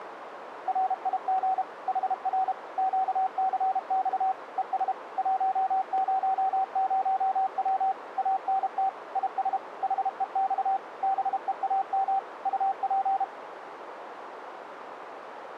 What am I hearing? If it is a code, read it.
Morse code, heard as a keyed tone, machine-sent, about 32 wpm, 770 Hz, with radio static and a narrow filter. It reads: RIG HR QCX ES 100W ANT IS HEX BEAM UP